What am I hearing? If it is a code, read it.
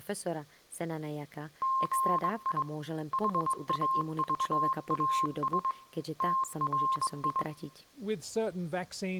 Morse code, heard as a keyed tone, hand-sent with a straight key, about 21 wpm, 1060 Hz, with speech in Slovak. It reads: GI HAVAS TRI